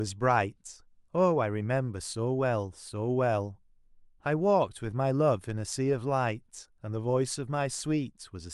Speech in English. There is no code.